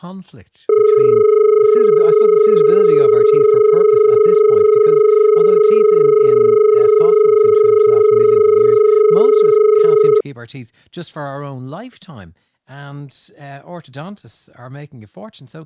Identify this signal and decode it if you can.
Telephone call progress tone (as in Australia), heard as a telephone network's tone, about 430 Hz, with speech in English. Dial tone.